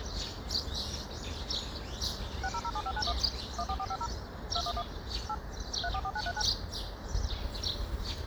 DTMF, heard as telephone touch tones, dialled by machine, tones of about 60 ms, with the noise of a park. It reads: 6007591 14450 211 8 344939